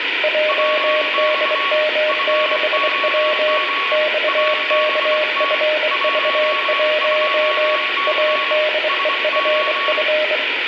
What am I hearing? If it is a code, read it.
Morse code, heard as two keyed tones, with radio static and room echo. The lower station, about 24 wpm, 610 Hz: JDM6W XKFV1 ADEFF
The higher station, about 24 wpm, 1120 Hz: WX FOG ABT 12C SO